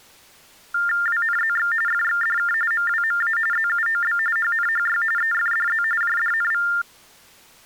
TTY/TDD text telephone tones (45.45 baud Baudot), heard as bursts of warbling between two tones, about 400 Hz shift, 1600 Hz centre. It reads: WNZX FXDK MWMA ZUOB HNHY EFDZ JDNV